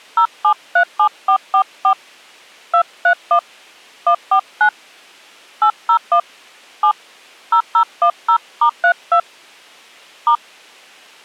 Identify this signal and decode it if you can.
DTMF, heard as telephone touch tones, dialled by hand, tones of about 80 ms. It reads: 0737444 231 149 801 7 0010*32 *